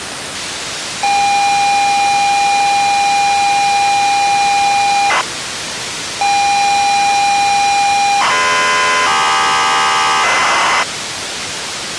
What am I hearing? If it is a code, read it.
ZX Spectrum tape loading, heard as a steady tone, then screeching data, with tape hiss.